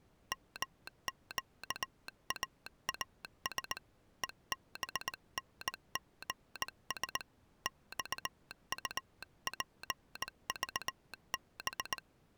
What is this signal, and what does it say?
Morse code, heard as a telegraph sounder, hand-sent with a straight key, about 19 wpm. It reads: MQAAS EBNGS XUPVB